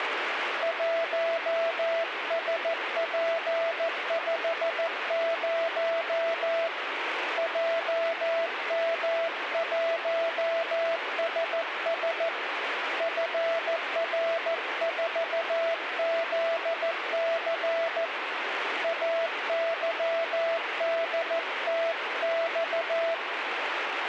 Morse code, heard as a keyed tone, hand-sent with a paddle, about 14 wpm, 660 Hz, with radio static. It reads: 1SP50 JM1SS FR4ZC AYDTX